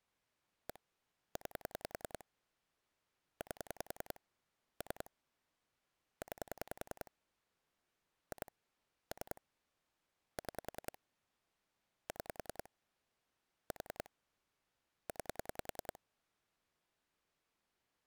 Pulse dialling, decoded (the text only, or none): 1 9 8 3 9 2 3 6 6 4 9